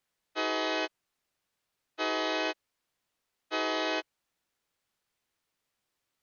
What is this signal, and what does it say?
Train horn signal, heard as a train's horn. 3 short. On North American railways: when stopped, the train will back up.